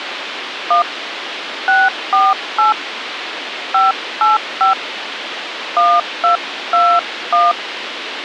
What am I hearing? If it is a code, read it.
DTMF, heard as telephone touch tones, dialled by hand, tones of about 200 ms, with radio hiss. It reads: 1 648 585 1221